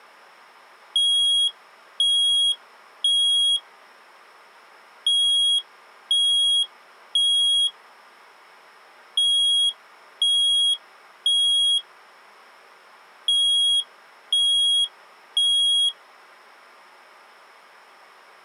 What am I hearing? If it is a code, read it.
Alarm pattern, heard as an alarm's beeps, played four times, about 3300 Hz. Temporal three. Smoke or fire, evacuate.